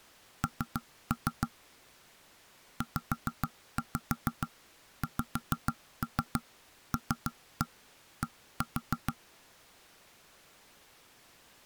Tap code, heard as knocks on wood, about 6 knocks a second. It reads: N ZXLD